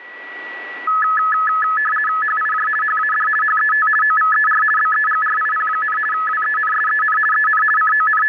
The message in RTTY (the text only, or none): HIJ HAD HET OVER BEGRIP, WENSEN EN …